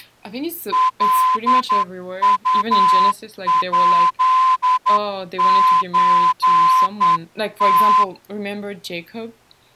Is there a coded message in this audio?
Yes: Morse code (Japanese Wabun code) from 0.7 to 8.1 s, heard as a whistle, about 10 wpm, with speech in English. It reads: カウヱソム